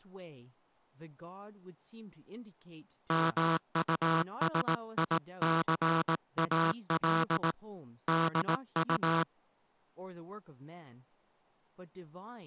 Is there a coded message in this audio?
Yes: Morse code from 3.0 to 9.3 s, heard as a buzzer, hand-sent with a paddle, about 18 wpm, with speech in English. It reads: MUSICAL DU